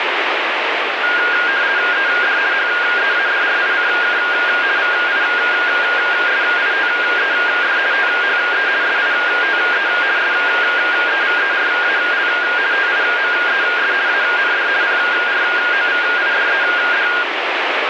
RTTY (50 baud, 170 Hz shift), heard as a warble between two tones, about 1500 Hz centre, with radio static. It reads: ED HEADRICK VISITED THE SITE SEVERAL TIMES AND PROVIDED